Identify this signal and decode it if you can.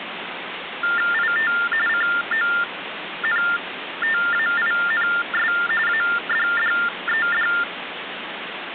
TTY/TDD text telephone tones (45.45 baud Baudot), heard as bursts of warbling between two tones, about 400 Hz shift, 1600 Hz centre, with phone line noise. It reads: IT CONTAINS ADDED